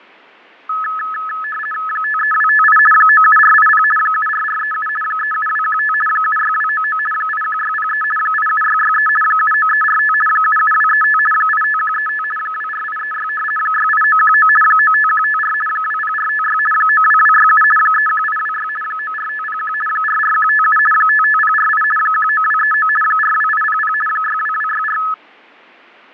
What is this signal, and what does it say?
RTTY (50 baud, 450 Hz shift), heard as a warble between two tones, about 1500 Hz centre, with fading. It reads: 53258 97480 74437 37215 76299 81603 87663 79345 77235 85135 24836 68919 95154 20456 92267 31826 94501 44157 55048 19239 42800 62264